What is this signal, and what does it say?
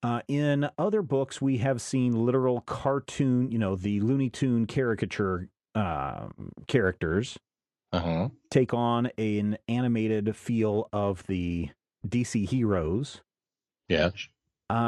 Speech in English. There is no code.